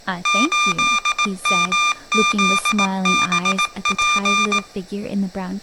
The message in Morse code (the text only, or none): 8MZBP